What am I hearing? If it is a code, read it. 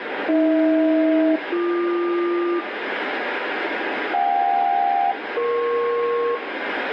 Aircraft SELCAL, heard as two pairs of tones, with radio static and room echo. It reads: AH-BQ JK-EP